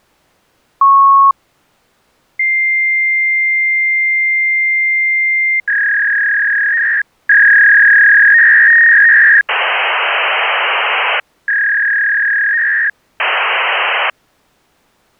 Fax machine handshake, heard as a beep, a long tone, a warble and hiss.